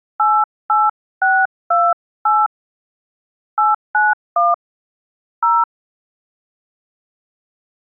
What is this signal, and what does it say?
DTMF, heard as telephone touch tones, dialled by hand, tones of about 200 ms. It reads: 88628 891 0